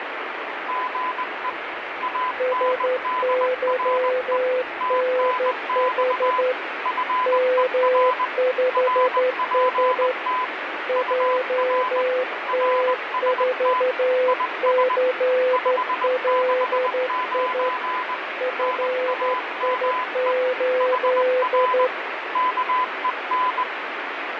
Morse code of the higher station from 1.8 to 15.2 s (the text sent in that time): ANDRE TNX FER RPT UR RST IS